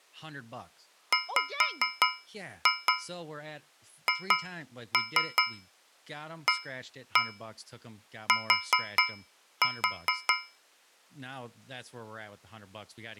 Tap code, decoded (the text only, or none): WHAT